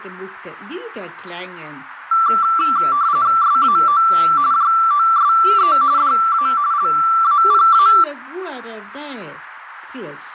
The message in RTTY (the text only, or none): SAO JOSE DA LAPA